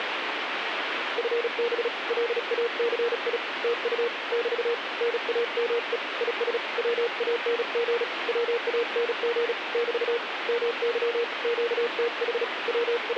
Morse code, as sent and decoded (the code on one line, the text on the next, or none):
..-. -... / .-.. .- -.-. .. / - ..- / -...- / -. .- -- . / .. ... / .-- .- -. --. / .-- .- -. --. / -...- / -- -.-- / --.- - .... / …
FB LACI TU <BT> NAME IS WANG WANG <BT> MY QTH …